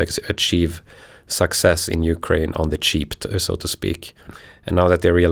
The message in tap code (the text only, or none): none